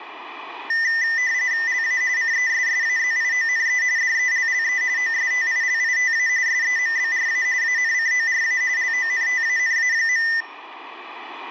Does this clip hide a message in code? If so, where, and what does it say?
Yes: RTTY (45.45 baud, 170 Hz shift) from 0.7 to 10.4 s, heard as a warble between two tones, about 1900 Hz centre, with radio static. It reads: LA CESSAZIONE DELLE OSTILITA SEMBRA ANCORA LONTANA.